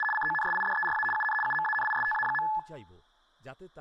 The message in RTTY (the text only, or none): … CONSIDERA UN UMANISTA.